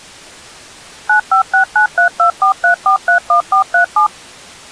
DTMF, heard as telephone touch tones, dialled by machine, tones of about 100 ms. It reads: 95693243431437